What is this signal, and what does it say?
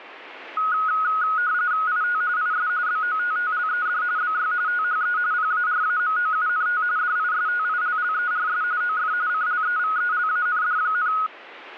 RTTY (45.45 baud, 170 Hz shift), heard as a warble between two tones, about 1360 Hz centre, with radio static. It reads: IT IS BOTTLED BY THE PARAMOUNT DISTILLERS OF CLEVELAND,